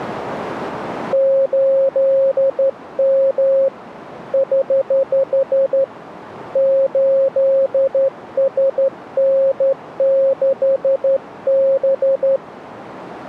Morse code, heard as a keyed tone, hand-sent with a straight key, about 12 wpm, 540 Hz. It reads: 8M <HH> 8SN6B